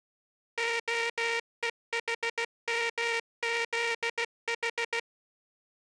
Morse code, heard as a buzzer, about 16 wpm. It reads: OEHMZH